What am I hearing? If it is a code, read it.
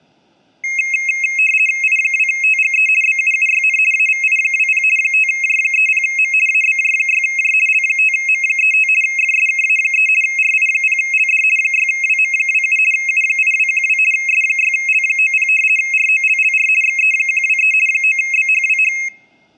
RTTY (50 baud, 450 Hz shift), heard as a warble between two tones, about 2350 Hz centre. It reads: I2TGE BUUYN AVI20 5J30M ABJ6J L5M35 FSKA3 RI0LD 6WM27 U8212 S6L90 ROLLR XE123 9BHWH